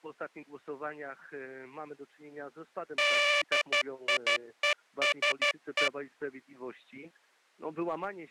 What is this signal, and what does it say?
Morse code, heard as a buzzer, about 12 wpm. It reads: DIESE